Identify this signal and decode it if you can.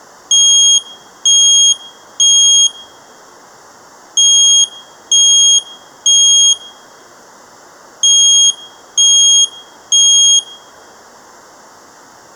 Alarm pattern, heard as an alarm's beeps, played three times, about 3250 Hz, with room echo. Temporal three. Smoke or fire, evacuate.